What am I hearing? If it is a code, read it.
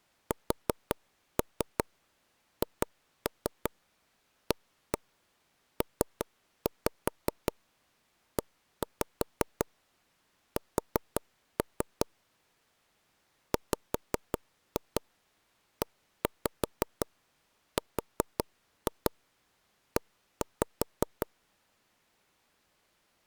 Tap code, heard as taps on a table, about 5 knocks a second. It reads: SHAPES WERE